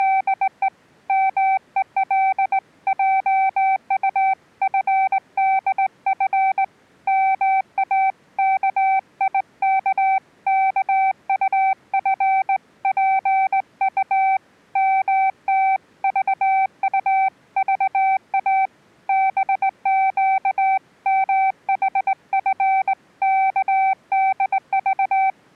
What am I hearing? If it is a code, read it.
Morse code (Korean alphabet), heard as a keyed tone, hand-sent with a straight key, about 19 wpm, 770 Hz. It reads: … 막히는 모양인지 머리로 대문을